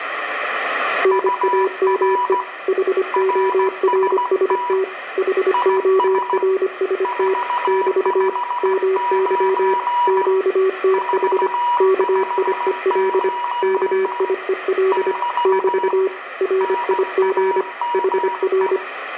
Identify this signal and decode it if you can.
Morse code, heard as two keyed tones, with radio static and room echo. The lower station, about 25 wpm, 380 Hz: NAME HORST HORST <BT> MY QTH KIEL KIEL <BT> RIG HR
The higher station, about 16 wpm, 970 Hz: UR RST IS 459 459 <BT> NAME